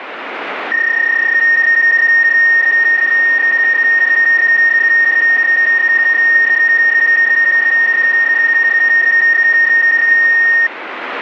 PSK31 (31.25 baud), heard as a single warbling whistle, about 1850 Hz, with radio static.